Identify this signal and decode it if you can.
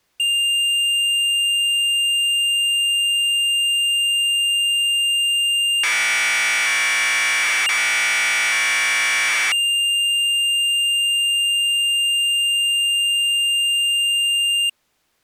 Commodore tape loading (standard loader), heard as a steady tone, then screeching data.